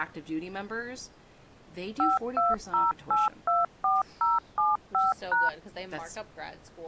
DTMF, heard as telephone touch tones, dialled by machine, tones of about 180 ms, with speech in English. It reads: 520824075#